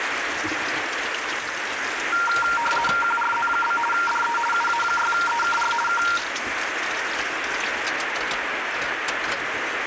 RTTY (50 baud, 450 Hz shift), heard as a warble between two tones, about 1160 Hz centre, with radio static and kitchen noise. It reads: QRZ? DE UA6EKR K